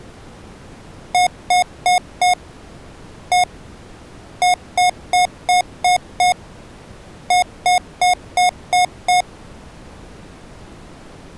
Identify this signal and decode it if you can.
Beep code, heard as beeps from a small speaker, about 720 Hz. 4-1-6-6.